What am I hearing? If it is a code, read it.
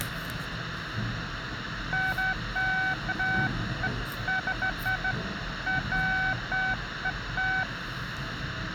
Beeps of irregular length, with the noise inside a lift. There is no code.